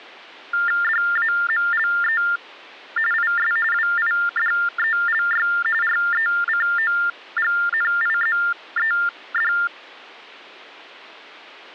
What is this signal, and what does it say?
TTY/TDD text telephone tones (45.45 baud Baudot), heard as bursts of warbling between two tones, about 400 Hz shift, 1600 Hz centre. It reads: DAMLE IS WIDELY RECOGNIZED